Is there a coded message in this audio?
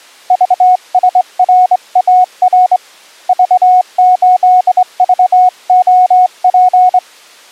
Yes: Morse code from 0.2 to 7.0 s, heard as a keyed tone, hand-sent with a straight key, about 23 wpm, 730 Hz. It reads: VSRAR V8VOP